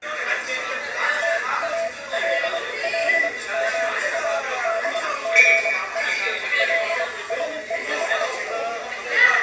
Morse code, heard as a keyed tone, machine-sent, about 24 wpm, spaced as for 19 wpm, 670 Hz, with room echo and the noise of a crowd indoors. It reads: TALLMADGE LIES